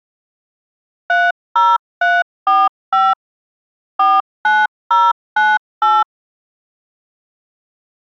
DTMF, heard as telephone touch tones, dialled by machine, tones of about 210 ms. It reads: 30345 49098